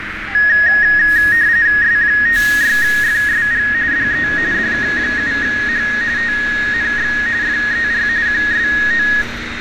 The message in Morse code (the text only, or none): none